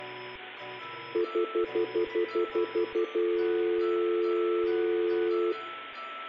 Telephone call progress tone (North American plan), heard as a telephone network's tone, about 350, 440 Hz, 0.1 s on and 0.1 s off, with room echo. Stutter dial tone.